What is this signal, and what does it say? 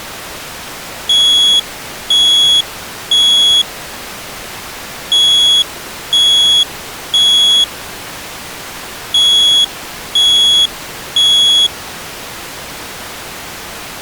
Alarm pattern, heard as an alarm's beeps, played three times, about 3350 Hz. Temporal three. Smoke or fire, evacuate.